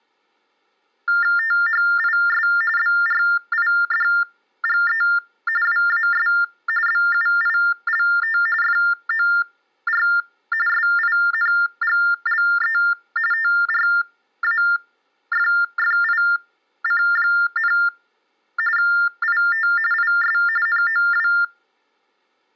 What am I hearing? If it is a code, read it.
TTY/TDD text telephone tones (45.45 baud Baudot), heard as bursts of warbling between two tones, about 400 Hz shift, 1600 Hz centre. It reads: THIS BRIDGE WAS BUILT FOR SINGLE TRAFFIC, IT IS NOW